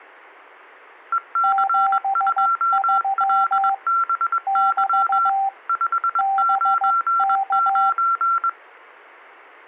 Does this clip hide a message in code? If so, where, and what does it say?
Yes: Morse code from 1.1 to 8.6 s, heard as two keyed tones. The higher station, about 21 wpm, 1360 Hz: EC2LBY 599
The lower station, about 15 wpm, 780 Hz: 73 <BT> BK